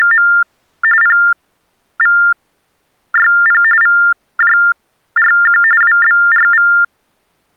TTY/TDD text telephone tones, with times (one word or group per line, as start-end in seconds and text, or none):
0.0-0.3 …
1.0-3.6 PVYP
3.8-5.6 VJRQ
5.8-6.7 WBRV